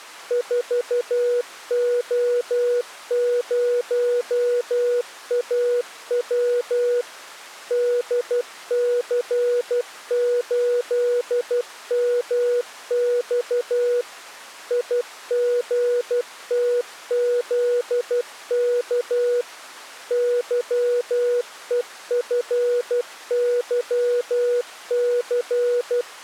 Morse code, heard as a keyed tone, machine-sent, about 12 wpm, 490 Hz. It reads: 4O0AW DC8MX IGTZK YEFYC